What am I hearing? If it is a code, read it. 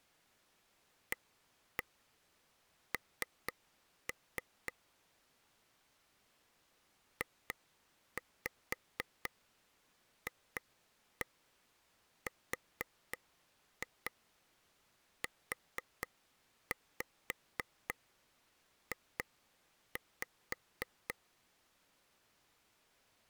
Tap code, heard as taps on a table, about 4 knocks a second. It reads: AN JFRUJ